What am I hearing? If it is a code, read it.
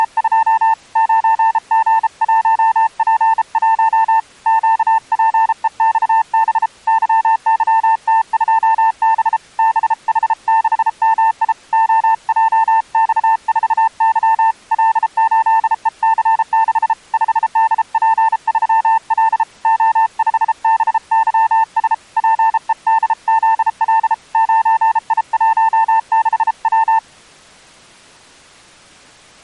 Morse code, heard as a keyed tone, hand-sent with a bug key, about 33 wpm, 900 Hz. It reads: … 9G1P1 QPEXB YYT2B BH6MI OJX4Y L8EC6 5DP3L O5BYS PEDZL 9I16W